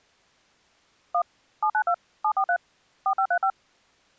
DTMF, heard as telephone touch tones, dialled by machine, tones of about 80 ms. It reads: 1 792 743 4535